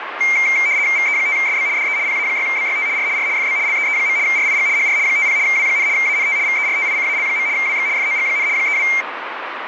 RTTY (75 baud, 170 Hz shift), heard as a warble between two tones, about 2200 Hz centre, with radio static. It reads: VE5SB DE PA6BYT R R FB LEE. RIG HR 50 W, ANT VERTICAL. WX FOG, 32